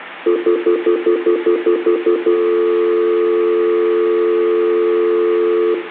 Telephone call progress tone (North American plan), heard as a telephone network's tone, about 350, 440 Hz, 0.1 s on and 0.1 s off, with room echo. Stutter dial tone.